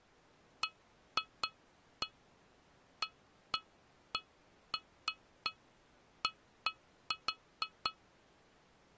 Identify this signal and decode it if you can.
Irregular taps on glass. There is no code.